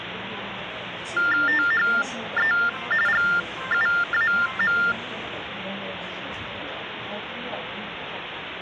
TTY/TDD text telephone tones (45.45 baud Baudot), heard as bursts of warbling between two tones, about 400 Hz shift, 1600 Hz centre, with phone line noise and the noise inside a subway train. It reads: THE GUAM